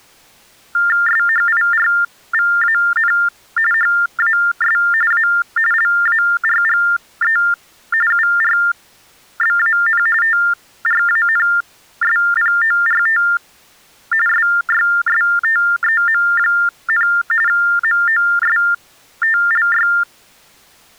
TTY/TDD text telephone tones (45.45 baud Baudot), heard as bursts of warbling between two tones, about 400 Hz shift, 1600 Hz centre. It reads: SHIRVAN HAS A LARGE URBAN TRANSPORT SYSTEM, MOSTLY